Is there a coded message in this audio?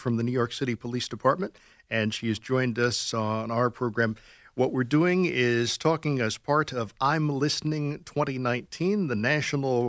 No, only speech in English.